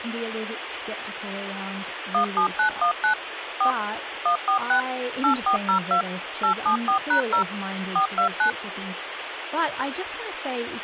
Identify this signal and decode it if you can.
DTMF, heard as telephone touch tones, dialled by machine, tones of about 100 ms, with phone line noise and speech in English. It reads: 17919 4 146 8402 874#0 429